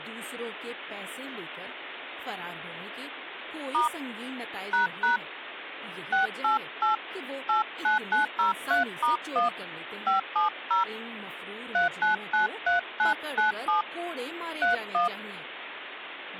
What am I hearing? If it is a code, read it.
DTMF, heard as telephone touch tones, dialled by hand, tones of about 130 ms, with phone line noise and speech in Urdu. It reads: * ## 688 89903*1 570 3993997 31